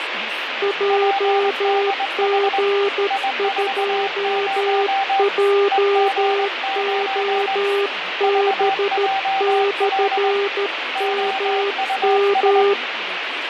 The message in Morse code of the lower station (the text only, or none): JG2JOB/MM